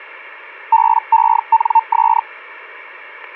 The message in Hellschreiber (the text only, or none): BENS